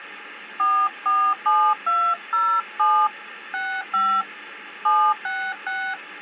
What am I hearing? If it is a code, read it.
DTMF, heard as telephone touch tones, dialled by hand, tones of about 270 ms. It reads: 447207 65 766